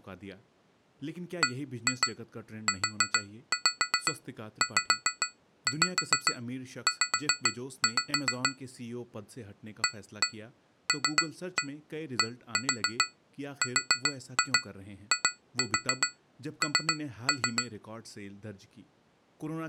Tap code, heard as taps on glass, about 7 knocks a second, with speech in Urdu. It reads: BUZZ ALDRIN